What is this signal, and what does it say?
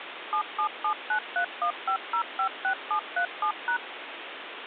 DTMF, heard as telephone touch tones, dialled by machine, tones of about 90 ms, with phone line noise. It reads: 7779315056737#